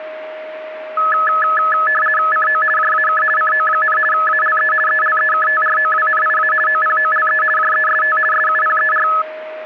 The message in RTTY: CO JAK CO, ALE ELEKTROWNIA OPOLE JEST SUPER

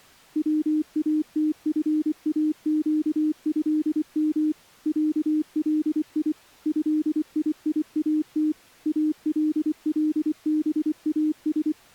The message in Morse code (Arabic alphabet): واتفاقهم علي هييات اللباس

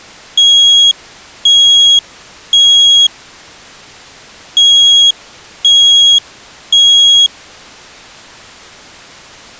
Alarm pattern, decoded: temporal three

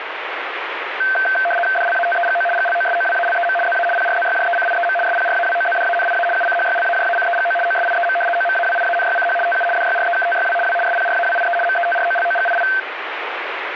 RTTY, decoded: DLATEGO GLOSOWALEM ZA PRZYJECIEM SPRAWOZDANIA UCHYLAJACEGO OSIEM OMAWIANYCH TU DYREKTYW W SPRAWIE METROLOGII

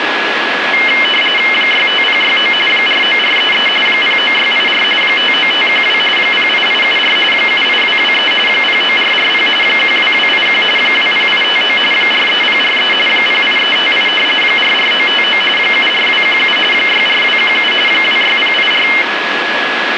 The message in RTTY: 65069 49433 09684 59512 08874 78223 09440 12281 20859 43043 08358 44959 74217 64217 26084

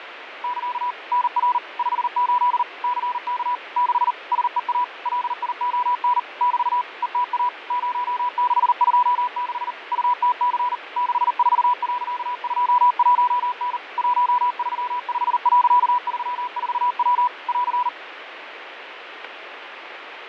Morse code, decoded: <KA> NR 58 CK 6 SEA LION <BT> ETA 0626 UTC 64.21N 135.34W <AR>

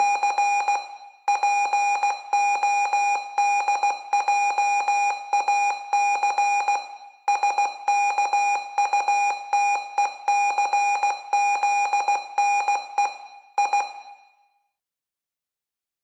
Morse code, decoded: … PODJAC SKUTECZNE I

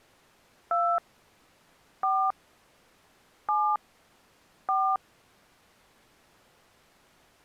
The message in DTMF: 2 4 7 4

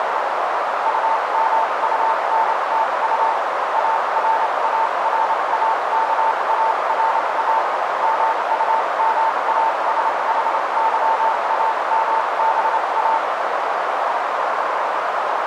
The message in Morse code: UMUNTU ARARAKARA MUMASHYAMBA

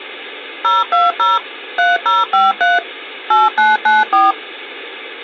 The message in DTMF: 020 3053 8994

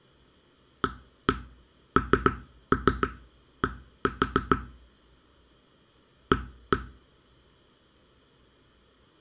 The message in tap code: AND A

